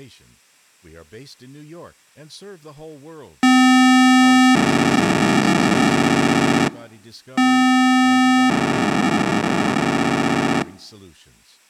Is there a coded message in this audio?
Yes: POCSAG pager data (512 baud) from 3.4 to 10.6 s, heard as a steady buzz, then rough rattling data, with speech in English.